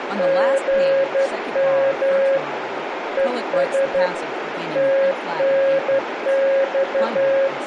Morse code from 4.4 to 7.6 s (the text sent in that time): TNX